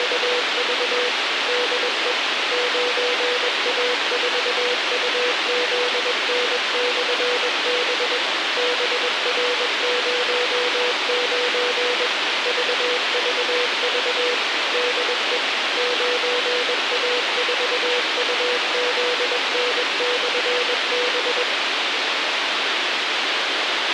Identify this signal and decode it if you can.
Morse code, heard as a keyed tone, machine-sent, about 21 wpm, 490 Hz, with radio hiss and a squelch burst at the end. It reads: … DE 9A4UZN/B BR09 VVV DE 9A4UZN/B